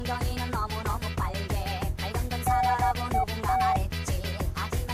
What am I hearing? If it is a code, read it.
Morse code (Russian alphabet), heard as a keyed tone, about 14 wpm, 760 Hz. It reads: НЕТ